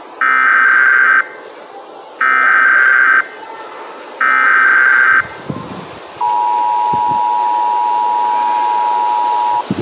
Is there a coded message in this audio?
Yes: Emergency Alert System (SAME) tones (header bursts, then the 853 and 960 Hz attention tone) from 0.2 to 9.6 s, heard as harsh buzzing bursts, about 520.83 baud, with the noise of a residential street.